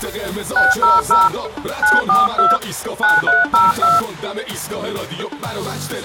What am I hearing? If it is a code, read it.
DTMF, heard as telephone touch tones, dialled by hand, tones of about 180 ms. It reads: 600 942 9302